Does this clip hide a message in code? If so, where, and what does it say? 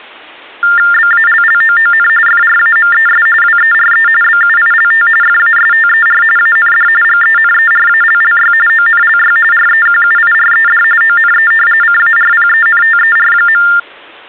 Yes: TTY/TDD text telephone tones (45.45 baud Baudot) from 0.6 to 13.8 s, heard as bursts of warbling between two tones, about 400 Hz shift, 1600 Hz centre. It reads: BALLOON FRAMES WERE BUILT FASTER AND GENERALLY ONLY REQUIRED ONE CARPENTER.